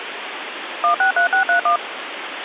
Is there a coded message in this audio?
Yes: DTMF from 0.8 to 1.8 s, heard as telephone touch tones, dialled by machine, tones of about 110 ms, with phone line noise. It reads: 163631